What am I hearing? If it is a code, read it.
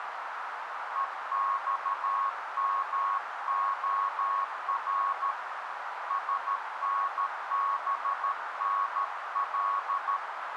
Morse code, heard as a keyed tone, hand-sent with a paddle, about 13 wpm, 1100 Hz, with radio static and a narrow filter. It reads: EXMOR SNBNL